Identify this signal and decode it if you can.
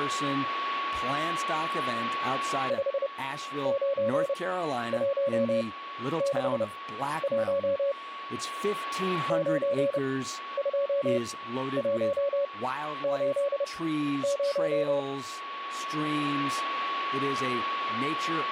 Morse code, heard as a keyed tone, machine-sent, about 30 wpm, spaced as for 12 wpm, 560 Hz, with a steady whistle near 1120 Hz and speech in English. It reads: 59161 92180